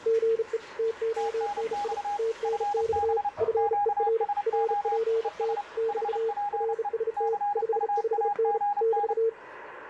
Morse code, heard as two keyed tones, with radio static and the noise of a restroom. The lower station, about 35 wpm, 450 Hz: GE TONI TNX FER RPT <BT> RST 55N <BT>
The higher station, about 30 wpm, 820 Hz: TNX FB QSO ES HPE CUAGN